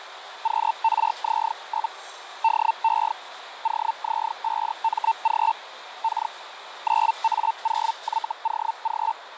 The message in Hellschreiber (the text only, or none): QRZ? DE OZ5MG K 9A0YOG